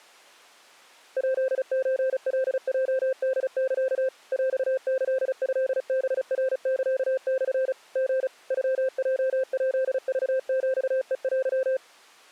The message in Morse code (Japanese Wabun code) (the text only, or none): ヱソカヲホサ ヰキトハナサモ リ ノヲヱクヒヘテ